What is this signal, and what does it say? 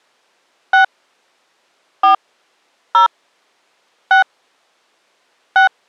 DTMF, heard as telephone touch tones, dialled by hand, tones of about 120 ms. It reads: 6 4 0 6 6